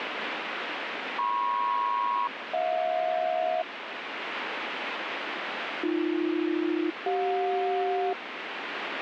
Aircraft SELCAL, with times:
1.2-3.6 MP-HJ
5.8-8.1 AB-CJ

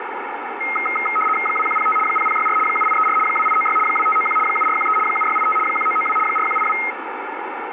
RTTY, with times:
1.5-2.0 2105
2.1-2.6 0064
2.7-3.2 7834
3.3-3.8 2896
3.9-4.4 2591
4.5-5.0 7413
5.1-5.6 7685
5.7-6.2 1992
6.3-6.8 4182

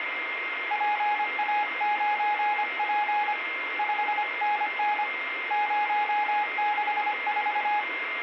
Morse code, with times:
0.7-3.3 PA9P
3.8-5.0 5NN
5.5-7.8 064

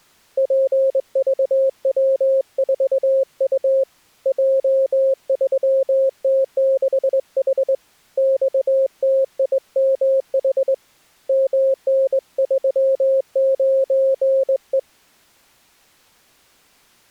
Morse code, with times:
0.4-3.8 PVW4U
4.3-7.7 J3T6H
8.2-10.7 XTIMH
11.3-14.8 MN39E

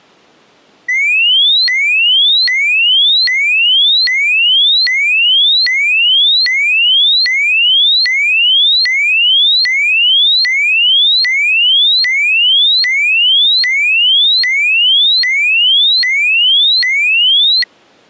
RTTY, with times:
none

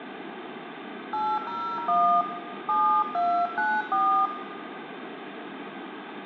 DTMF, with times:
1.1-2.2 801
2.7-4.3 7294

